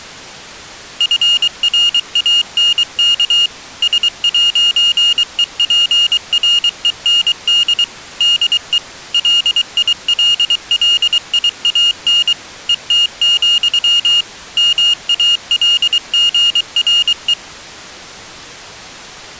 Morse code, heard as a high beeper, machine-sent, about 23 wpm, 2850 Hz. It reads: FRANK S'EPREND DE LILLIAN ET, MALGRE